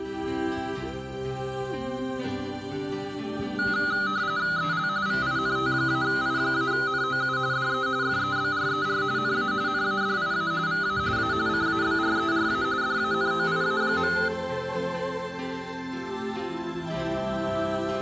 RTTY (45.45 baud, 170 Hz shift), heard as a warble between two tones, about 1360 Hz centre, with room echo. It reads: EL VINT-I-NOU DE FEBRER NA NADIA VA A CABRERA DANOIA.